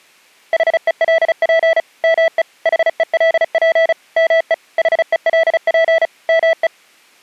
Morse code, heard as a keyed tone, machine-sent, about 35 wpm, 660 Hz. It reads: HELP ME HELP ME HELP ME